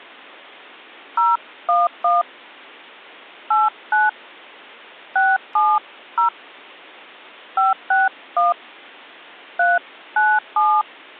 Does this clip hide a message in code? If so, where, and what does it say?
Yes: DTMF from 1.2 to 10.8 s, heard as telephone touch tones, dialled by hand, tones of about 190 ms. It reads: 011 89 670 561 397